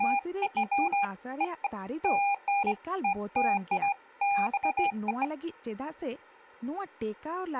Beeps of irregular length, with speech in Santali. There is no code.